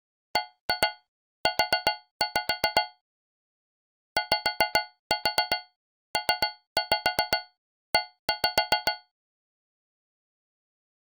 Tap code, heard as taps on a metal pipe, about 7 knocks a second. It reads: BU YPE